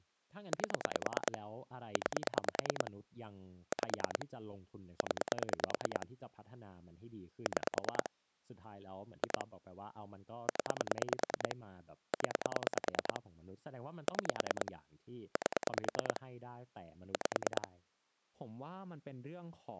Pulse dialling, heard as clicks on a phone line, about 9 pulses a second, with speech in Thai. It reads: 8 9 5 0 6 2 0 0 6 8 5